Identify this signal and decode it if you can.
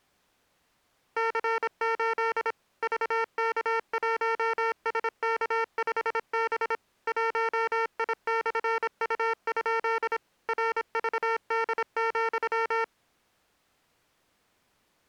Morse code, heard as electronic beeps, machine-sent, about 26 wpm, 450 Hz. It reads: C8 VK1SK5B 1I/U? RVD,